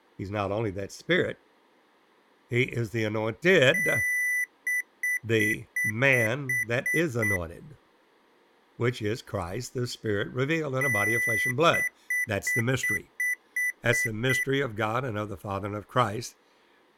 Beep code, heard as beeps from a small speaker, played twice, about 2000 Hz, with speech in English. 1 long, 8 short. In AMI BIOS tables: display or retrace test failure.